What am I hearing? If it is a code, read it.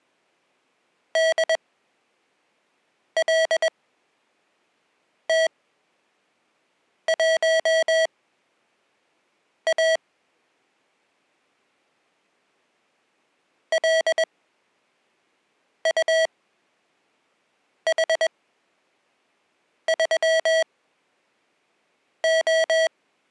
Morse code, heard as electronic beeps, machine-sent, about 21 wpm, spaced as for 5 wpm, 650 Hz. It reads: DLT1A LUH3O